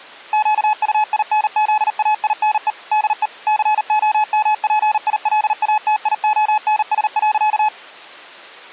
Morse code, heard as a keyed tone, machine-sent, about 39 wpm, 850 Hz. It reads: QUINZAINE DE COMPILATIONS.